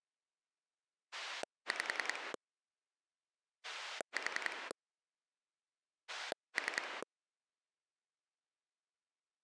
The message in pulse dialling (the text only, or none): 5 4 3